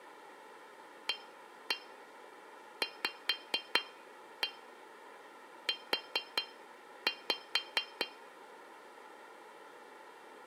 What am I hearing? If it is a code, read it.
Tap code, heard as taps on glass, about 4 knocks a second, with room echo. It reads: AVU